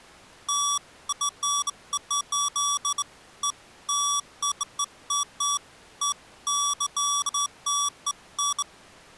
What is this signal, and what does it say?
Beeps of irregular length. There is no code.